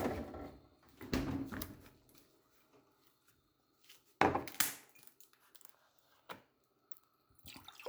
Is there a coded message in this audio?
No, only kitchen noise.